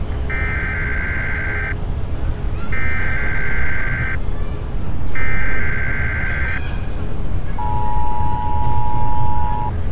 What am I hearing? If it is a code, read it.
Emergency Alert System (SAME) tones (header bursts, then the 853 and 960 Hz attention tone), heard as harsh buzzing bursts, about 520.83 baud, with street noise.